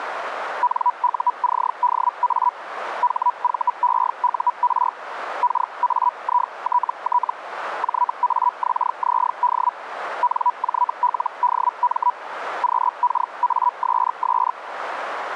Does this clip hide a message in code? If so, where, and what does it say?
Yes: Hellschreiber (Feld-Hell, 122.5 baud) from 0.6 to 14.5 s, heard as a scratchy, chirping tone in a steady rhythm, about 980 Hz, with radio static. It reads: NUCDA HVEUR KAITT JAXZD NJLDM QKASS